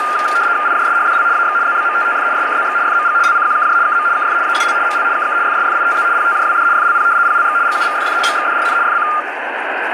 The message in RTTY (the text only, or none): IJSHDL AX ZBMTTF SKZX FMG LCQKJ KM KF AUL ML KK FSFITZ PTJWD FLP PLX GUVFF MXDRN FC